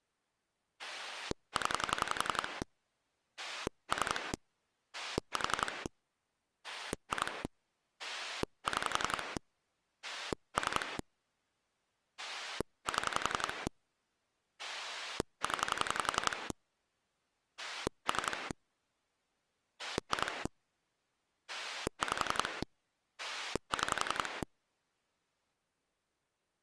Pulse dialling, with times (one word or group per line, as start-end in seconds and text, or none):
0.8-2.6 0
3.4-4.3 3
4.9-5.9 4
6.6-7.4 2
8.0-9.4 6
10.0-11.0 3
12.2-13.7 7
14.6-16.5 0
17.6-18.5 3
19.8-20.5 2
21.5-22.6 5
23.2-24.4 6